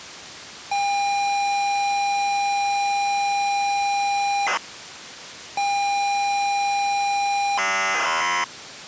ZX Spectrum tape loading, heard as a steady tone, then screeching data.